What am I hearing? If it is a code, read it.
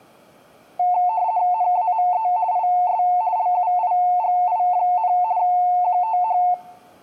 RTTY (50 baud, 170 Hz shift), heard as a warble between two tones, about 800 Hz centre. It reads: NAME IS LUIGI, QTH